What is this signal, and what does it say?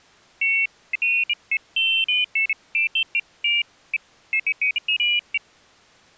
Pairs of high tones at irregular times. There is no code.